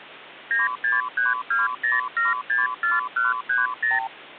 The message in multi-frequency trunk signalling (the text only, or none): 96320764130